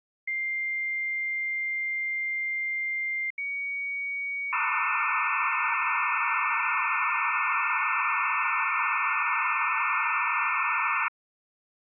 Dial-up modem handshake (low-speed, two carriers), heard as two whistles, then hiss.